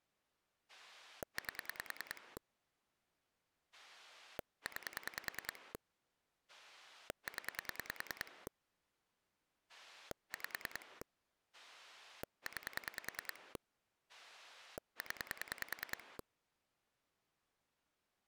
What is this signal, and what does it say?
Pulse dialling, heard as a rotary dial, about 10 pulses a second. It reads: 8 9 0 5 9 0